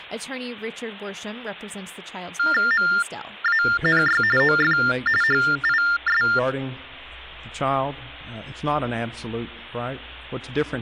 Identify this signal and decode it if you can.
TTY/TDD text telephone tones (45.45 baud Baudot), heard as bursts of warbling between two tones, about 400 Hz shift, 1600 Hz centre. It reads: MANY OF HIS